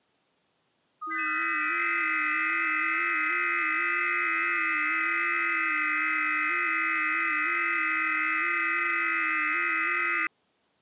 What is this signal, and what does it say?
FT8 (several signals at once), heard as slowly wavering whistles, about 6.25 baud.